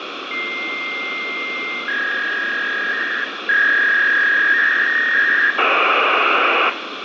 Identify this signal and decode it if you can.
Fax machine handshake, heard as a long tone, a warble and hiss, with phone line noise and room echo.